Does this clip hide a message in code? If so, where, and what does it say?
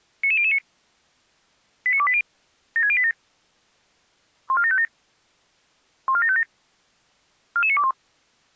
Yes: five-tone selective call (ZVEI) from 0.2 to 7.9 s, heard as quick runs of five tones, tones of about 70 ms. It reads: 99009 89280 76087 14757 14757 44921